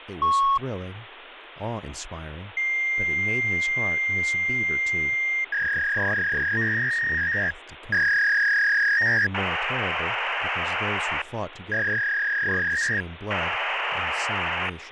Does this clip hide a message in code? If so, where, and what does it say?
Yes: fax machine handshake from 0.2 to 14.7 s, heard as a long tone, a warble and hiss, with phone line noise and speech in English.